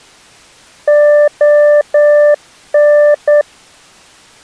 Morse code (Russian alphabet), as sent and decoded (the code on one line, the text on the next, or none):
--- -.
ОН